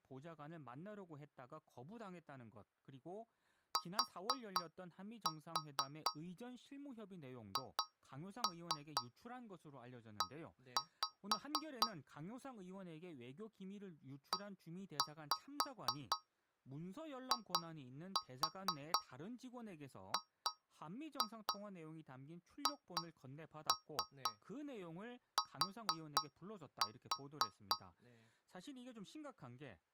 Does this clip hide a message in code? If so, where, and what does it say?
Yes: tap code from 3.8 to 27.9 s, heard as taps on a metal pipe, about 4 knocks a second, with speech in Korean. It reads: THE EIGHT